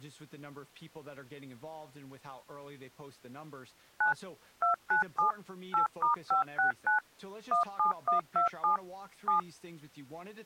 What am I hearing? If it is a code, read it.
DTMF, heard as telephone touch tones, dialled by machine, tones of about 120 ms, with speech in English. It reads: 9 297 8*569 17127 7